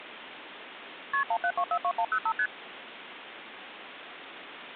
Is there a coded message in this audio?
Yes: multi-frequency trunk signalling (R1, as on North American trunks) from 1.1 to 2.5 s, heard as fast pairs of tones, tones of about 70 ms, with phone line noise. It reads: KP 17242105 ST